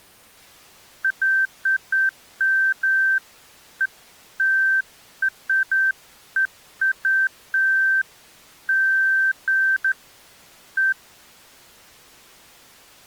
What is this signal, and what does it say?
Beeps of irregular length. There is no code.